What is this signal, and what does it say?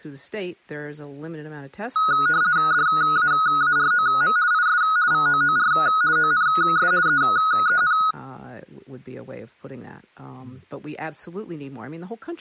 RTTY (50 baud, 170 Hz shift), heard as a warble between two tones, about 1360 Hz centre, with speech in English. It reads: DAAROM IS VOOR ONS EEN